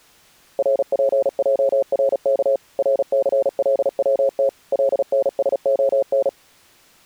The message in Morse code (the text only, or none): RPJRK RCLWT LNSON